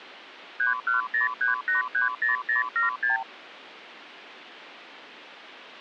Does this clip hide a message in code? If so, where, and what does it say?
Yes: multi-frequency trunk signalling (R2, with the far end's replies) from 0.6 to 3.2 s, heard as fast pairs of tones, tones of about 140 ms. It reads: 3103830076